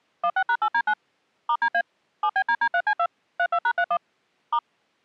DTMF, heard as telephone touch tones, dialled by machine, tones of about 70 ms. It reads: 16#8D9 *DA 7BDD3C2 32#31 *